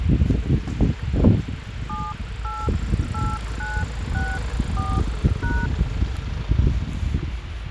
DTMF, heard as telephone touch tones, dialled by hand, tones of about 230 ms, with phone line noise and the noise of a residential street. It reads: 788964#